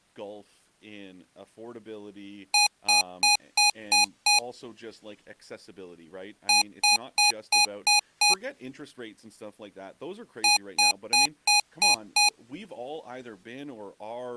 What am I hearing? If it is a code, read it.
Beep code, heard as beeps from a small speaker, played three times, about 830 Hz, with speech in English. 6 short. In AMI BIOS tables: keyboard controller gate A20 failure; in Dell tables: video card failure.